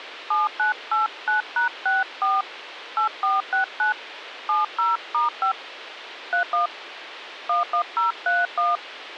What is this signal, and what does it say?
DTMF, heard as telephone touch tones, dialled by hand, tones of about 140 ms, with radio hiss. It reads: 7989#64 8469 70*5 31 11031